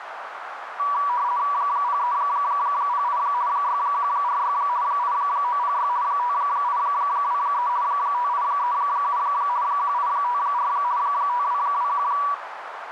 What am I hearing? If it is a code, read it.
RTTY (50 baud, 170 Hz shift), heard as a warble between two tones, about 1060 Hz centre, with radio static and a narrow filter. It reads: 0308 6146 8906 5823 5837 1854 5221